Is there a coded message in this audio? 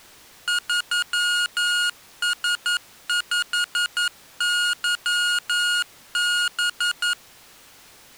Yes: Morse code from 0.4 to 7.2 s, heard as electronic beeps, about 11 wpm, 1430 Hz. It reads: 3S5YB